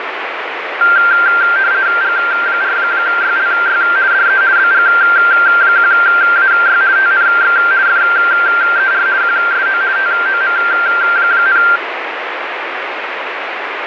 RTTY (50 baud, 170 Hz shift), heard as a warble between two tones, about 1480 Hz centre, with radio static. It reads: G4YLY DE BG1AY TNX FER QSO TOM,